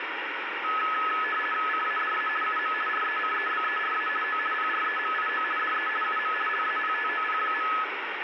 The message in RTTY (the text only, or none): CADA UM RECEBERA O PREMIO DE UM LAPTOP.